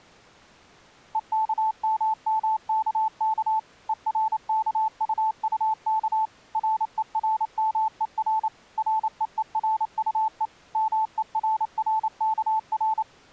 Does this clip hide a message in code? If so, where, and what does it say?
Yes: Morse code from 1.1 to 13.1 s, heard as a keyed tone, machine-sent, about 28 wpm, 880 Hz. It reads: EKMMKK ERKUUK RERMER REERUE MERRKR